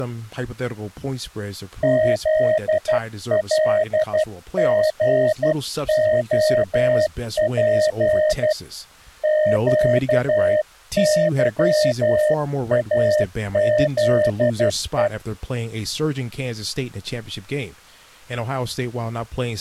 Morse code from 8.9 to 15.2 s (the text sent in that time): QYAZE